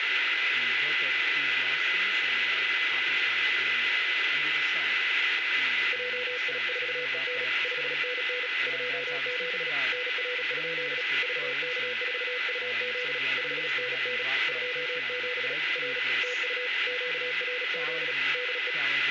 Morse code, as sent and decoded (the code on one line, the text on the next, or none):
.--- .. ....- . -. / ..... -. -. / ..--- --... / -. .-. ..--.. / ...- -.- ....- ..- --.. / ..... -. -. / ..--- --... / .-. / - ..- / --.- .-. --.. / -.. .
JI4EN 5NN 27 NR? VK4UZ 5NN 27 R TU QRZ DE